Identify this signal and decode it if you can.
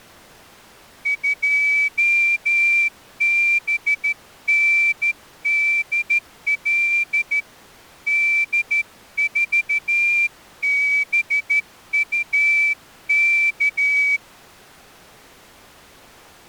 Morse code, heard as a whistle, hand-sent with a straight key, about 13 wpm. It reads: 2BNDL D4BUK